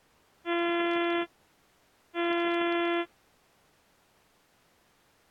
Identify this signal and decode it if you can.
Ship horn signal, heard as a ship's horn, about 340 Hz. 2 short. At sea: I am altering course to port.